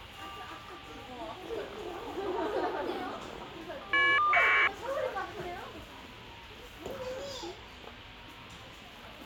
Caller ID data burst, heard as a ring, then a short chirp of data, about 1200 baud, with the noise of a crowd indoors.